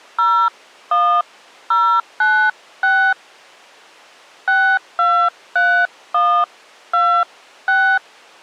DTMF, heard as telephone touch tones, dialled by hand, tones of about 300 ms. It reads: 01096 623126